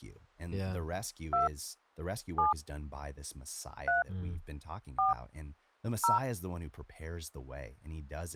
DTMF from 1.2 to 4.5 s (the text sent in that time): 2 7 3